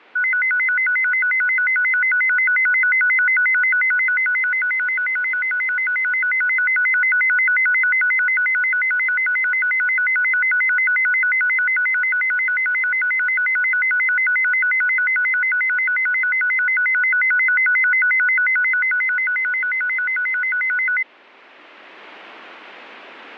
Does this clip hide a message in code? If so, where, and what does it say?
No, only a tone that alternates evenly between two pitches.